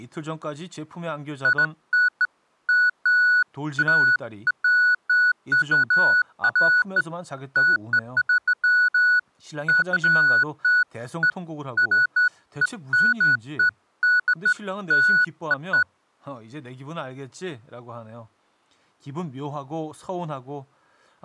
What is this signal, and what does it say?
Beeps of irregular length, with speech in Korean. There is no code.